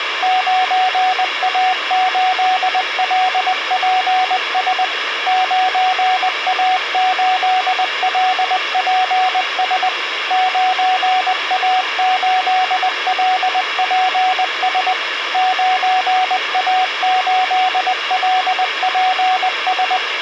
Morse code, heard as a keyed tone, machine-sent, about 20 wpm, 740 Hz, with radio hiss. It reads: 9A8LPS 9A8LPS 9A8LPS 9A8LPS